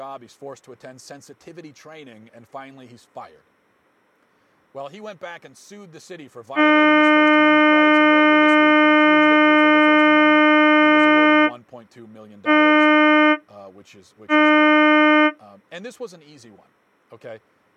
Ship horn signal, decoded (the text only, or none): 1 long, 2 short